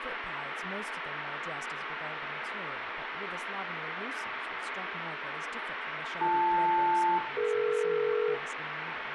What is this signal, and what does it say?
Aircraft SELCAL, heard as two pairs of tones, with radio hiss, room echo and speech in English. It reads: BL-DE